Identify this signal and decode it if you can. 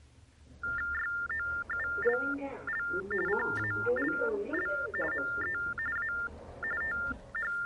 TTY/TDD text telephone tones (45.45 baud Baudot), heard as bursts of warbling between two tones, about 400 Hz shift, 1600 Hz centre, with the noise inside a lift. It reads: YOULL CALL ME A …